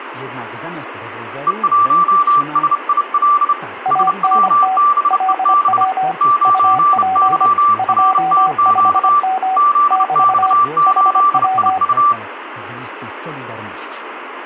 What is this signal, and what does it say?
Morse code, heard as two keyed tones, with radio static and speech in Polish. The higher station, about 30 wpm, 1170 Hz: E1SIL SWBEB 9YRTQ ZX8IU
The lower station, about 25 wpm, 760 Hz: ANT LW UP 25M <BT> HW